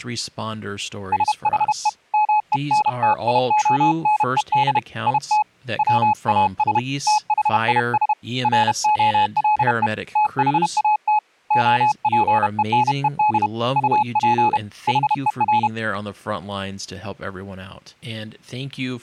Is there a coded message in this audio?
Yes: Morse code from 1.1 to 15.7 s, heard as a keyed tone, hand-sent with a paddle, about 31 wpm, 850 Hz, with speech in English. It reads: SHE MENTIONED IT WAS THIS ROLE THAT OPENED UP HER